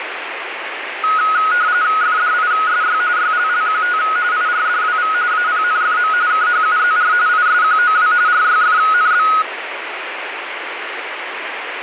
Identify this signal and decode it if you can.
RTTY (45.45 baud, 170 Hz shift), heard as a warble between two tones, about 1360 Hz centre, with radio static. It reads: FDISY YLLQT IRDWV APNFM KHUZR ISQOW RYFNB